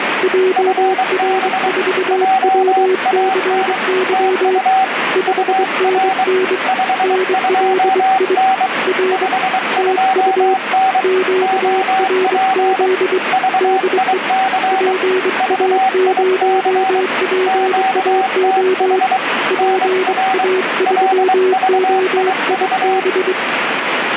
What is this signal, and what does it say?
Morse code, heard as two keyed tones, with radio static. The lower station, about 23 wpm, 370 Hz: JR4WCY 5NN NLI R TU QRZ DE PA0PAO PA3OIB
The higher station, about 23 wpm, 760 Hz: FB JAN TU UR 52N 52N OP VIC VIC QTH NR LVIV